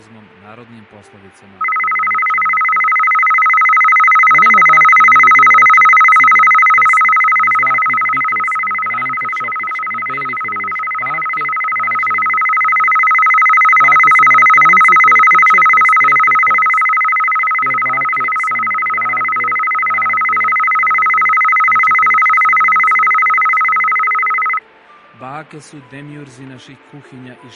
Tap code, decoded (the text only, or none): none